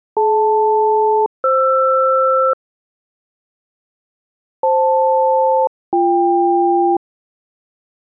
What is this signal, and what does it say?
Aircraft SELCAL, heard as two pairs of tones. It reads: DL-FR FL-BK